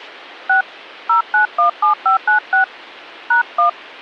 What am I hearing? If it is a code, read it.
DTMF, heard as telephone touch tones, dialled by hand, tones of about 120 ms. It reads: 6 0917596 #1